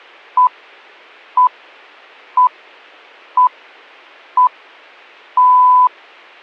Radio time signal (six pips, as the Greenwich Time Signal), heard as pips.